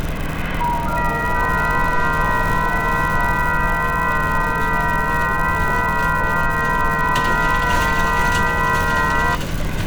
FT8 (several signals at once), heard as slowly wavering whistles, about 6.25 baud, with radio static, room echo and street noise.